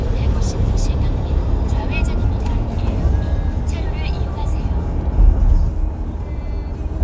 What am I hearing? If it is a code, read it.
The noise inside a car. There is no code.